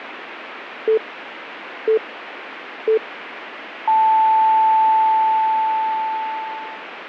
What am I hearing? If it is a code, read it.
Radio time signal (three low pips and a long one an octave up, as on NHK), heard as pips.